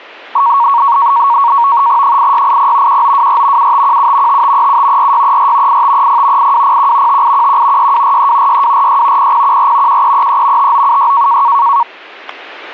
NAVTEX (SITOR-B), 100 baud, 170 Hz shift, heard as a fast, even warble, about 1020 Hz centre, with static crashes. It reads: 8680 1924 7517 5537 4634 8530 8201 5811 6243 6246 0014 1333 5976